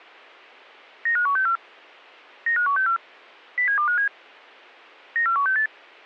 Five-tone selective call (CCIR), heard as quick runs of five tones, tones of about 100 ms. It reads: 95164 95164 07257 94168